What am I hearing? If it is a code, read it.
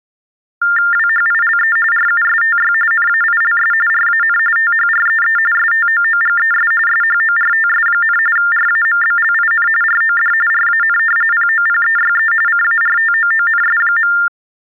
TTY/TDD text telephone tones (45.45 baud Baudot), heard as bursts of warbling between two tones, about 400 Hz shift, 1600 Hz centre. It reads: WHILE RUSTY NAILS RAN THREE STOOGES SHORTS, RAMBLIN ROD RAN POPEYE CARTOONS.